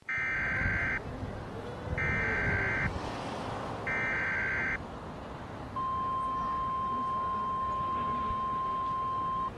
Emergency Alert System (SAME) tones (header bursts, then the 1050 Hz attention tone), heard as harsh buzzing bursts, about 520.83 baud, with the noise of a residential street.